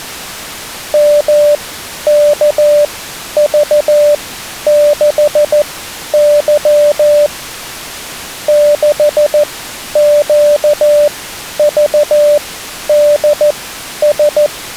Morse code, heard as a keyed tone, machine-sent, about 14 wpm, spaced as for 10 wpm, 590 Hz. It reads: MKV6Y 6QVDS